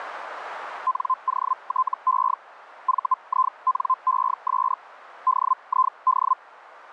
Hellschreiber (Feld-Hell, 122.5 baud), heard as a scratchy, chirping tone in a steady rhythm, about 1040 Hz, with radio static. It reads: NOTE VINES DID